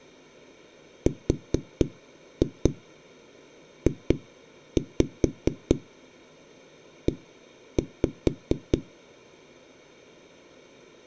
Tap code, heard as knocks on a wall, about 4 knocks a second. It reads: RJE